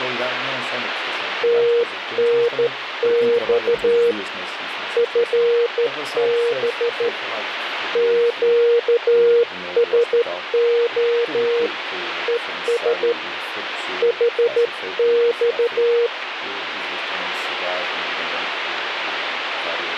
Morse code, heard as a keyed tone, hand-sent with a straight key, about 13 wpm, 470 Hz, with radio static. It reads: TNX FB QSO ES HX